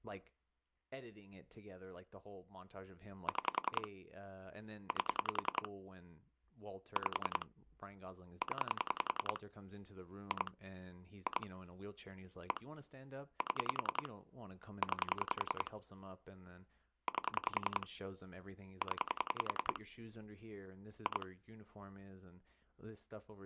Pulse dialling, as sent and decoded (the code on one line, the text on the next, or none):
6 / 8 / 5 / 10 / 2 / 2 / 1 / 7 / 9 / 8 / 10 / 2
6 8 5 0 2 2 1 7 9 8 0 2